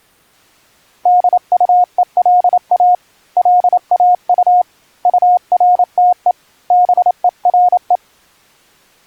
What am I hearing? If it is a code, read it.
Morse code, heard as a keyed tone, hand-sent with a paddle, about 28 wpm, 720 Hz. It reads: DUELA LAU URTE BERE